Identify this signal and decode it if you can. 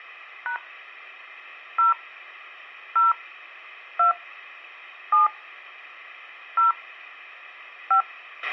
DTMF, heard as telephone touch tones, dialled by hand, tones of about 130 ms, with a squelch burst at the end. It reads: # 0 0 2 7 0 5